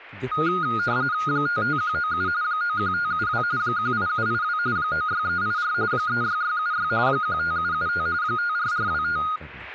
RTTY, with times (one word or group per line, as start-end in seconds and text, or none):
1.3-2.3 55197
2.4-3.4 91572
3.6-4.6 18782
4.8-5.7 96384
5.9-6.9 36676
7.1-8.1 15775
8.2-9.2 54425